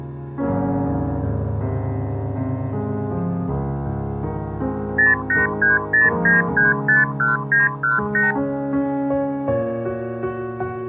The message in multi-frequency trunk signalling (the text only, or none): 08309351918